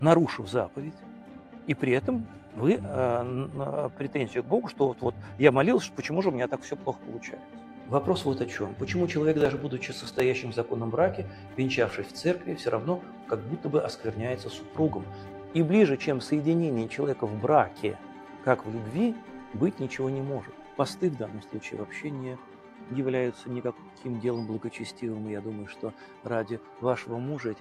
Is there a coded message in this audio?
No.